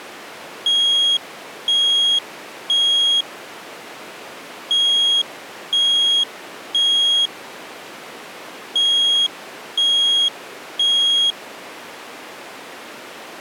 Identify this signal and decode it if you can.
Alarm pattern, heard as an alarm's beeps, played three times, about 3300 Hz. Temporal three. Smoke or fire, evacuate.